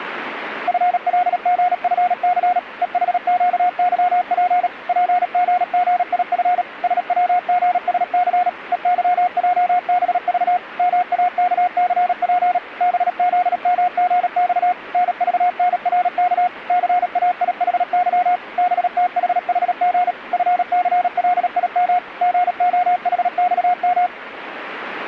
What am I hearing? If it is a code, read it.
Morse code, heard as a keyed tone, machine-sent, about 37 wpm, 720 Hz. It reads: FLGFC EHQYP PGGIF SWGSC EYJBV MAKCP BZMGX NVNRK CAIHY BTHHG FCLIM GOHXM